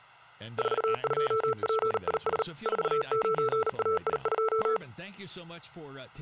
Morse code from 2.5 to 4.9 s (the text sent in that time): 49AI2